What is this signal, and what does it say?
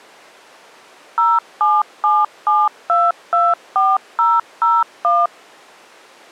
DTMF, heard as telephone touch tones, dialled by machine, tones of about 210 ms. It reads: 0777224001